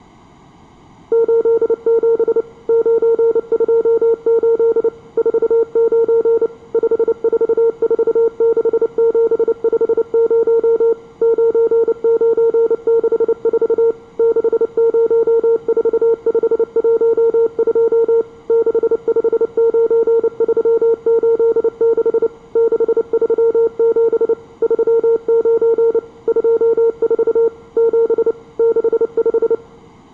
Morse code, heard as a keyed tone, machine-sent, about 29 wpm, 460 Hz. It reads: 87 928 49 5446750 9964 604512 659386 637 39 24 7 65